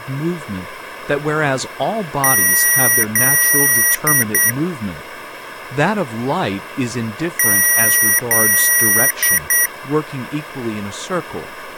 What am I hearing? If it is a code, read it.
Beep code, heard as beeps from a small speaker, played twice, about 1950 Hz, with speech in English. 2 long, 2 short.